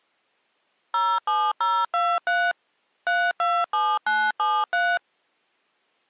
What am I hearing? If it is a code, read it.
DTMF, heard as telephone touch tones, dialled by machine, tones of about 240 ms. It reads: 07023 327973